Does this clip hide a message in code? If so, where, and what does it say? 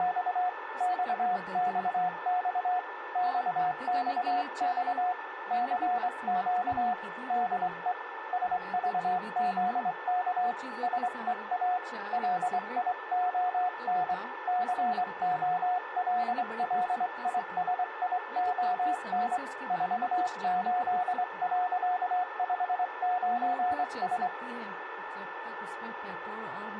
Yes: Morse code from 0.0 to 24.3 s, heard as a keyed tone, hand-sent with a straight key, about 24 wpm, 730 Hz, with radio static, a steady whistle near 1770 Hz and speech in Hindi. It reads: … XXX XXX CQ DE SVZK SEA LION COLLISION 48.59S